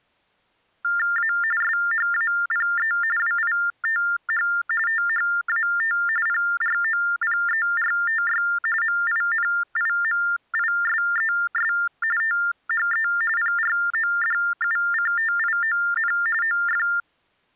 TTY/TDD text telephone tones (45.45 baud Baudot), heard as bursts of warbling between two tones, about 400 Hz shift, 1600 Hz centre. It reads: A SHAPE WITH THAT PROPERTY MINIMISES THE PRODUCTION OF